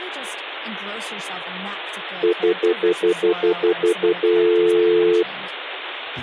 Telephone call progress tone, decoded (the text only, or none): stutter dial tone